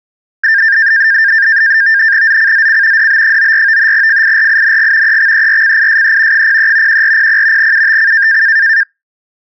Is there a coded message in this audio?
Yes: NAVTEX (SITOR-B), 100 baud, 170 Hz shift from 0.4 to 8.8 s, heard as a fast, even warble, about 1700 Hz centre. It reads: ZCZC DB94 FIRING EXERCISE 03 1400 UTC